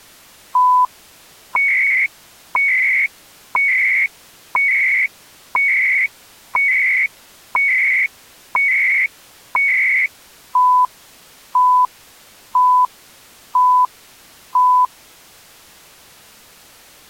Radio time signal (CHU, Canada), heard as beeps and data bursts, one a second.